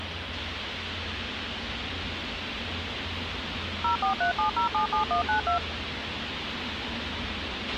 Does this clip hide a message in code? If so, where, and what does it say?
Yes: DTMF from 3.8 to 5.6 s, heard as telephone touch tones, dialled by machine, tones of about 110 ms, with radio hiss, a squelch burst at the end and street noise. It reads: 0437077192